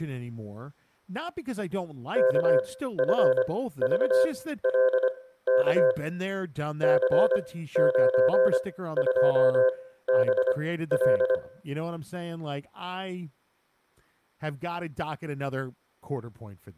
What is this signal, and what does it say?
Morse code, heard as a keyed tone, machine-sent, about 25 wpm, spaced as for 15 wpm, 520 Hz, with room echo and speech in English. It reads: KFVLK C92BL